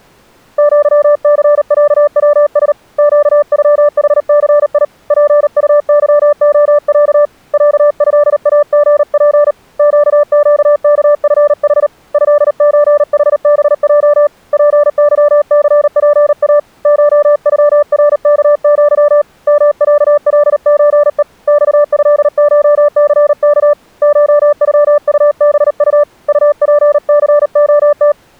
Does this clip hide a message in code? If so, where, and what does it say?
Yes: Morse code (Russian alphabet) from 0.5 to 28.2 s, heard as a keyed tone, hand-sent with a paddle, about 38 wpm, 590 Hz. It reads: ЪЦЯВС ЩЮХЦИ ПУЫОЯ ЯЭАГП ЩЩКФХ ЭЧХБЙ ПЫЦПА ШЮРКЪ МЯЛЧЕ ЬЭШЦК ШЮУБУ УПЦОТ